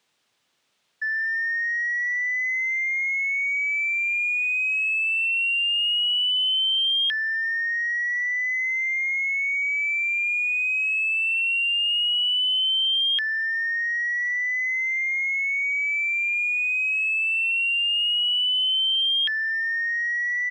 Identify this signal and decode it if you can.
A tone that sweeps in pitch again and again. There is no code.